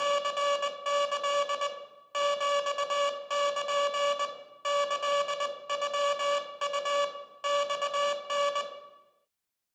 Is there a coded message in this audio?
Yes: Morse code (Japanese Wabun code) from 0.0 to 8.7 s, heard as a buzzer, hand-sent with a paddle, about 20 wpm, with room echo. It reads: … ヒル キノウ マタ